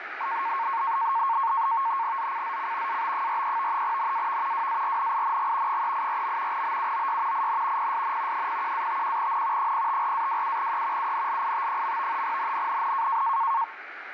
NAVTEX (SITOR-B), 100 baud, 170 Hz shift, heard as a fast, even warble, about 1000 Hz centre, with radio static. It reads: ZCZC AB43 NAV WARNING 384. BUOY IN PSN 01-51N 054-27E UNLIT. NNNN